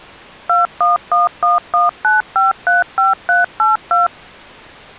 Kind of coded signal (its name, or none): DTMF